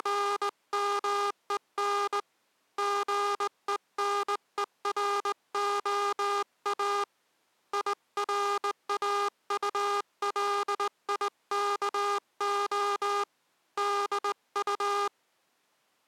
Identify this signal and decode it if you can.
Morse code, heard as a buzzer, hand-sent with a straight key, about 19 wpm. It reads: … GENEROA IRAULIKO DU